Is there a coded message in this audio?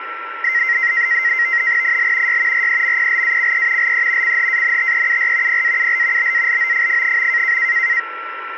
Yes: NAVTEX (SITOR-B), 100 baud, 170 Hz shift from 0.4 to 8.0 s, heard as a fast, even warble, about 2000 Hz centre, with radio static and a steady whistle near 1350 Hz. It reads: IL Y REMPLACE LE CHANTEUR PAUL BALOFF.